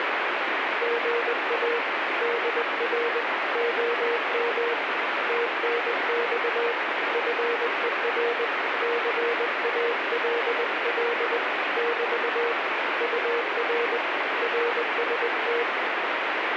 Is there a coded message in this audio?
Yes: Morse code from 0.8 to 15.7 s, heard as a keyed tone, hand-sent with a paddle, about 20 wpm, 470 Hz, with heavy radio static. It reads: GA DR OM TNX FER CALL <BT> UR RST